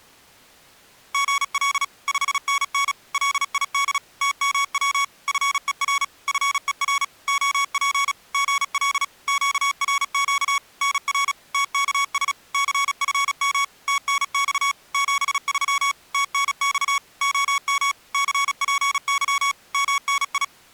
Morse code, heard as electronic beeps, machine-sent, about 36 wpm, 1120 Hz. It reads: GL 5NN LID TMW FER FER OP GL QRQ NR TKS CFM TNX 73 TNX OM CPY MNI